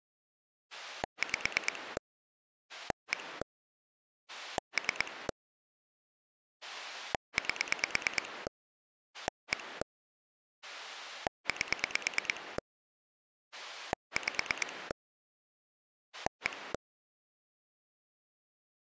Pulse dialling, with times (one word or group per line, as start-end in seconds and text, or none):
0.7-2.0 5
2.7-3.4 1
4.3-5.3 3
6.6-8.5 8
9.1-9.8 1
10.6-12.6 8
13.5-14.9 5
16.1-16.7 1